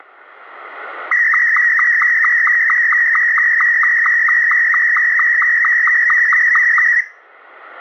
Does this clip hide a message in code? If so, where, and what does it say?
Yes: SSTV (slow-scan television), Martin M2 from 1.1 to 7.0 s, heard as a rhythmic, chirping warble, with static crashes and room echo.